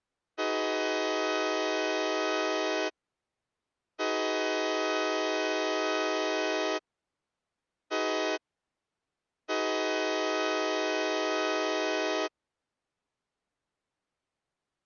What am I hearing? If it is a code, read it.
Train horn signal, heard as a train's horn. 2 long, 1 short, 1 long. On North American railways: approaching a public crossing.